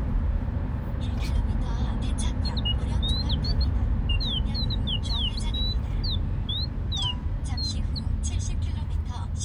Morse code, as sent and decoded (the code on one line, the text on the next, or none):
none